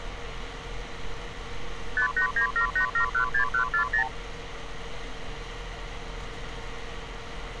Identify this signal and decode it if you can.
Multi-frequency trunk signalling (R2, with the far end's replies), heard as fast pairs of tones, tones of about 100 ms, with street noise. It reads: 58978716140